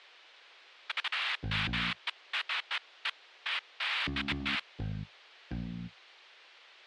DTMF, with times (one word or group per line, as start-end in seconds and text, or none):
none